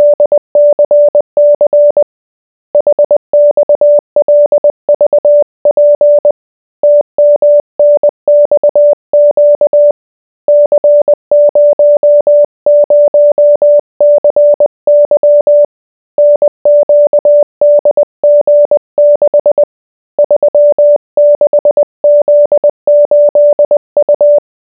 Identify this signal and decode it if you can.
Morse code, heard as a keyed tone, hand-sent with a paddle, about 20 wpm, 590 Hz. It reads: … HXLVP TMNXQ C00CY NQDG6 36Z8U